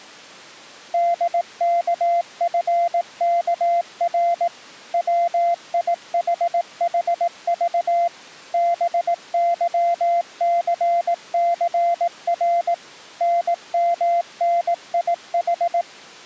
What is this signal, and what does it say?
Morse code, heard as a keyed tone, machine-sent, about 18 wpm, 690 Hz. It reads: DKFKR WIHHV BYCCR NMNIH